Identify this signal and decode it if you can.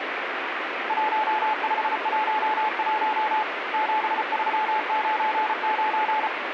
Morse code, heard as a keyed tone, hand-sent with a paddle, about 34 wpm, 860 Hz, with radio static. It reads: 1511 7399